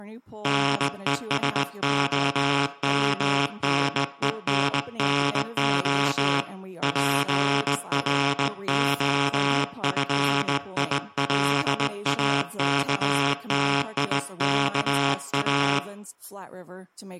Morse code (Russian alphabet), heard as a buzzer, hand-sent with a straight key, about 19 wpm, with room echo. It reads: НЕСОМНЕННО ПРОФИЛАКТИКА